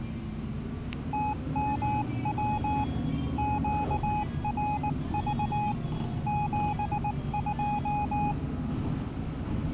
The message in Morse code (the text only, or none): TMW QRV 72